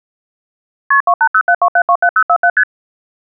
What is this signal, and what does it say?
Multi-frequency trunk signalling (R1, as on North American trunks), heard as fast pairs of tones, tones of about 70 ms. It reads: KP 28072727047 ST